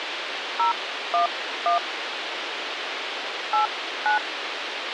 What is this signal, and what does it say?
DTMF, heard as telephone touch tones, dialled by hand, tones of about 120 ms, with radio hiss and a squelch burst at the end. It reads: 011 89